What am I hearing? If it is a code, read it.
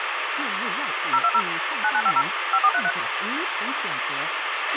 DTMF, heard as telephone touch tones, dialled by machine, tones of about 60 ms, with radio hiss and a squelch burst at the end. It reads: 020 9950 5433